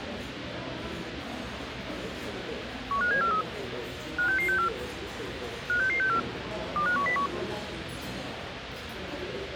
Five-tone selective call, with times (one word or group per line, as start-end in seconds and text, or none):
2.9-3.4 15743
4.2-4.7 56664
5.7-6.2 56664
6.8-7.3 25101